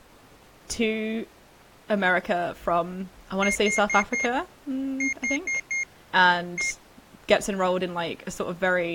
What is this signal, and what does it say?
Beep code, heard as a piezo beeper, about 2150 Hz, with speech in English. 4-4-1. In Phoenix BIOS tables: serial port failure.